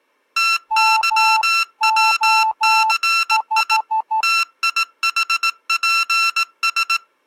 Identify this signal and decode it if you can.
Morse code (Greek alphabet), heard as electronic beeps, machine-sent, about 18 wpm, 1350 Hz. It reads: ΤΥΩΘΙ ΤΙΗΠΣ